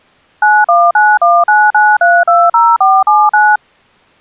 DTMF, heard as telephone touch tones, dialled by machine, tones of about 220 ms. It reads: 919199320479